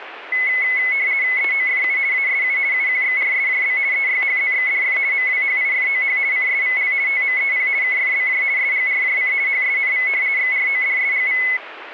RTTY (50 baud, 170 Hz shift), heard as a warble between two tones, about 2100 Hz centre, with radio static. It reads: EOFU ASU UQXRSJB EYHZXDF MWHIFOH CSVL TMEP KFBJ SGRJC HSNV XRODSGV